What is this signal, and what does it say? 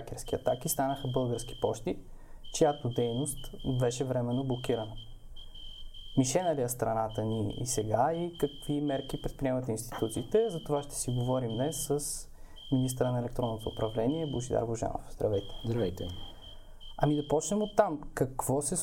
Morse code, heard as a whistle, hand-sent with a straight key, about 12 wpm, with room echo. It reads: … QRP HW GM NW CL